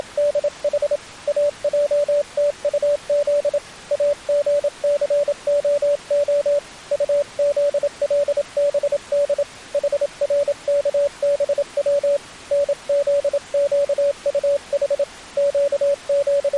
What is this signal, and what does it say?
Morse code (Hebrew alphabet), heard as a keyed tone, hand-sent with a paddle, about 27 wpm, 570 Hz. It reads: … אעתטז אגסהה טזלבד חרכבץ נזקטח …